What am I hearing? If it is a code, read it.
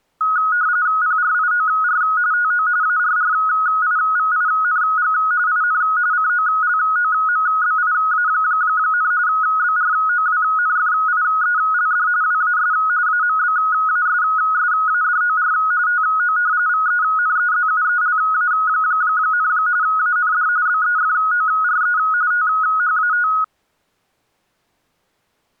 RTTY (45.45 baud, 170 Hz shift), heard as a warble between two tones, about 1360 Hz centre. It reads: PRIOR TO ARRIVING IN COLOMBIA, BROWNFIELD WAS AMBASSADOR TO VENEZUELA, AND BEFORE THAT